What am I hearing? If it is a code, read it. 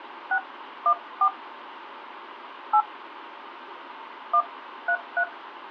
DTMF, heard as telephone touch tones, dialled by hand, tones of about 70 ms, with phone line noise. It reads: 614 8 133